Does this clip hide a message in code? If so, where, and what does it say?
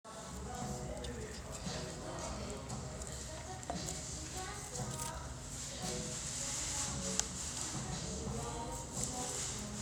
No, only the noise of a restaurant.